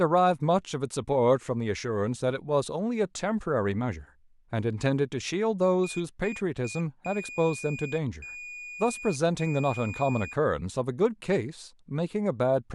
Beep code, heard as a piezo beeper, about 2450 Hz, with speech in English. 3 short, 3 long.